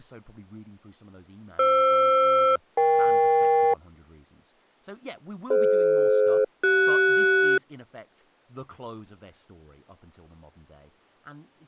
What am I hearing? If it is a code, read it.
Aircraft SELCAL, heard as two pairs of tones, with speech in English. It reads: FR-EK DF-CS